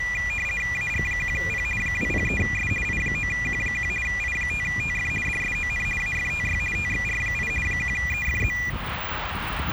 RTTY (50 baud, 450 Hz shift), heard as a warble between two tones, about 2200 Hz centre, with radio static and street noise. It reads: AG1P 203S I9Q1 I5TF DSON AFTY TXR8 1EFZ